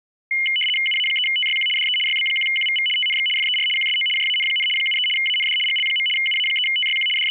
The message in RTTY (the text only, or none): UA3TYQ DE YB1QVV TNX FER QSO JAN, 73 AND GL. UA3TYQ …